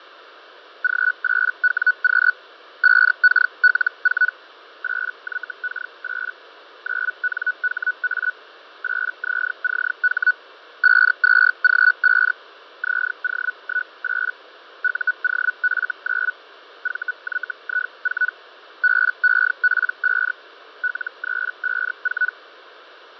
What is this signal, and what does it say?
Hellschreiber (Feld-Hell, 122.5 baud), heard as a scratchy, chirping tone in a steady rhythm, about 1480 Hz, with radio static and fading. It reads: G8WQ 5KL4 8YK8 9NHA 8ZCH 52G5 ZO18 UOF9 VYI4 BEP5 L354